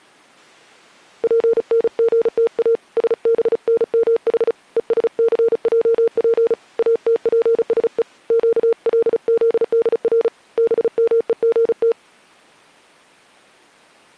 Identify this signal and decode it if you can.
Morse code (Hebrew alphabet), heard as a keyed tone, hand-sent with a paddle, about 35 wpm, 460 Hz. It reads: פנגתא שבנמח ושסעף אתפשו קלזדר במוגת